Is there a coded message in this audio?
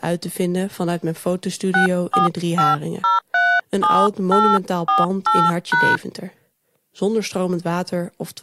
Yes: DTMF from 1.7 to 6.0 s, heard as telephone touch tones, dialled by hand, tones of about 200 ms. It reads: 645037848#